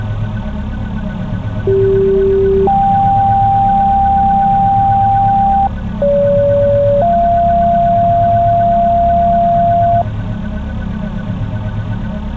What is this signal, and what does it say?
Two-tone page, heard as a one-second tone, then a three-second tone, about 390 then 790 Hz, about 570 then 690 Hz.